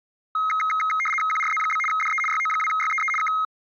RTTY (75 baud, 850 Hz shift), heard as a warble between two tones, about 1700 Hz centre. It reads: QRZ? DE YO2YEE K